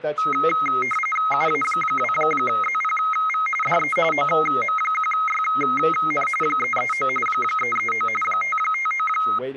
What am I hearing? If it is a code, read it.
RTTY (45.45 baud, 850 Hz shift), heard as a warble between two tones, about 1700 Hz centre, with speech in English. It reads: UA2ZPV DE OM1YN 339 339 559